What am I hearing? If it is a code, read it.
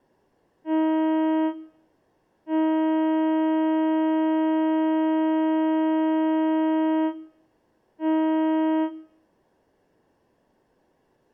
Ship horn signal, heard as a ship's horn, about 320 Hz, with room echo. 1 short, 1 long, 1 short. At sea: a vessel at anchor warns of its position.